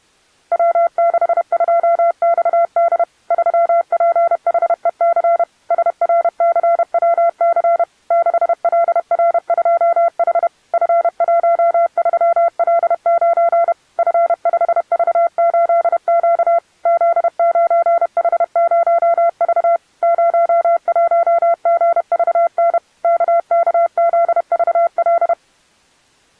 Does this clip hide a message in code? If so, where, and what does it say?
Yes: Morse code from 0.5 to 25.4 s, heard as a keyed tone, machine-sent, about 31 wpm, 680 Hz. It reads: W62XD 3PHEC SRCWC 6LR2H F13L9 F5V8Q Z9H0V 01GVN KKZVL